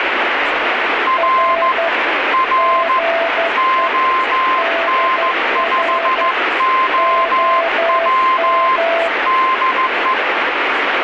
Morse code, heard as two keyed tones, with radio static. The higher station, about 15 wpm, 1040 Hz: R R ON5OW DE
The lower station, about 12 wpm, 670 Hz: R GE DR OM